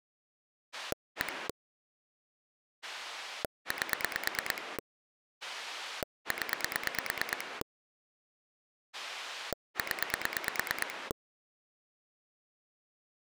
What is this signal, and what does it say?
Pulse dialling, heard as a rotary dial, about 9 pulses a second. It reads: 1 8 0 0